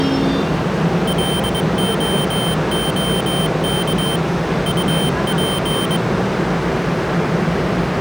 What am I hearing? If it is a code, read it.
Morse code, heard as a high beeper, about 22 wpm, 3100 Hz, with the noise of a subway station. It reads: LOOK UP